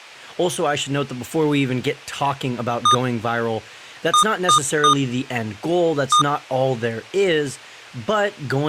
Beep code, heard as beeps from a small speaker, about 1220 Hz, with speech in English. 1-3-1. In Phoenix BIOS tables: memory refresh failure.